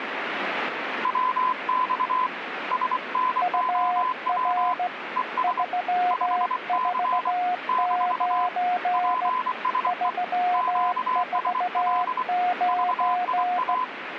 Morse code, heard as two keyed tones, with radio static. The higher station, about 24 wpm, 1020 Hz: WX SNOW ES 5C - PSE QSL VIA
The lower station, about 16 wpm, 720 Hz: UR 349 349